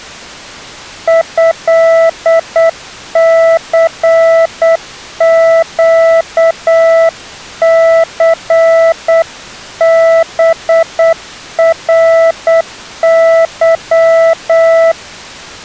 Morse code (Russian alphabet), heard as a keyed tone, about 8 wpm, 660 Hz. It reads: ЭЦЩЦБРЫ